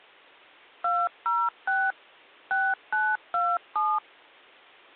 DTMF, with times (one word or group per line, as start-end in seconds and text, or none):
0.8-1.9 206
2.5-4.0 6927